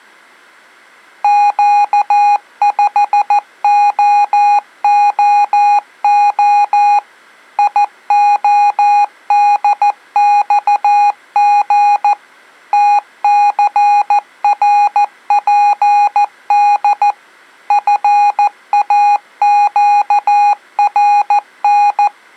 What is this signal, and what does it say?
Morse code, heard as electronic beeps, machine-sent, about 14 wpm, 820 Hz. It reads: Q5OOO IODXG TCRPD FAQRN